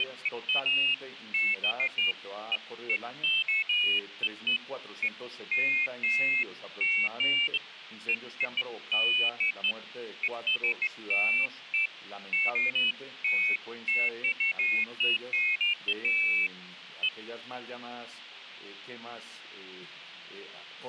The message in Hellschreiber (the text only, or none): none